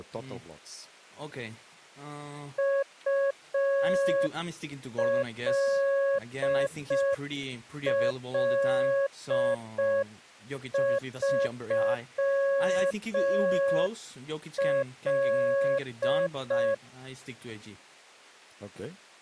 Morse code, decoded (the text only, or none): ULL3L